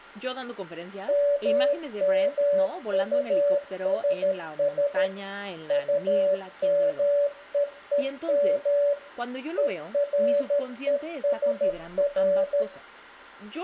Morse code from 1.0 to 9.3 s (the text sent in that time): MMUSS UMEEM